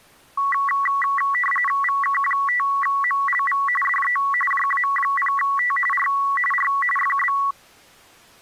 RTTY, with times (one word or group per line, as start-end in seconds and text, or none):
1.8-3.6 VK5MLV
3.8-4.2 DE
4.5-5.8 JA0T
5.9-6.1 R
6.5-6.7 R
7.0-7.4 FB